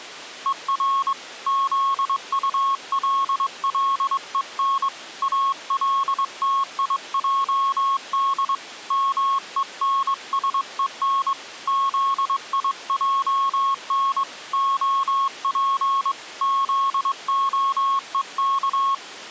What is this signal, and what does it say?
Morse code, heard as a keyed tone, hand-sent with a straight key, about 22 wpm, 1090 Hz. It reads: ER ZULLEN ALTIJD MENSEN ZIJN OP ZOEK